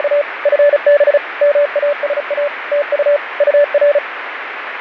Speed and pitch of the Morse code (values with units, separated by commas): 35 wpm, 580 Hz